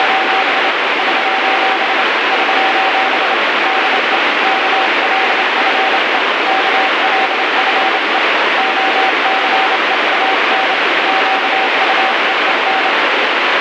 Morse code, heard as a keyed tone, hand-sent with a paddle, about 28 wpm, 770 Hz, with heavy radio static. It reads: … <SOS> <SOS> DE KLFE KLFE OCEAN QUEEN